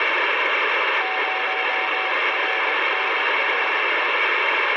Morse code, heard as a keyed tone, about 20 wpm, 750 Hz, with heavy radio static. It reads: 0RNRE